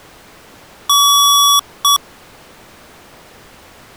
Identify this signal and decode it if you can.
Beep code, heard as beeps from a small speaker, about 1140 Hz. 1 long, 1 short. In IBM BIOS tables: system board problem.